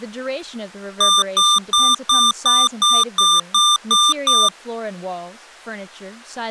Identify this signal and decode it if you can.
Beep code, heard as beeps from a small speaker, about 1190 Hz, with speech in English. 10 short. In AMI BIOS tables: CMOS shutdown register error.